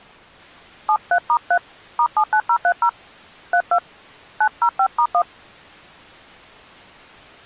DTMF, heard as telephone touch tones, dialled by hand, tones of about 70 ms. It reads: 73*3 *79030 32 905*1